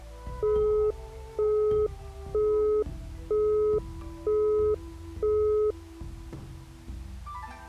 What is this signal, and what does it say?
Telephone call progress tone (single-tone plan, as in Europe, Japan and elsewhere), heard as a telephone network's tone, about 420 Hz, 0.48 s on and 0.48 s off. Busy tone.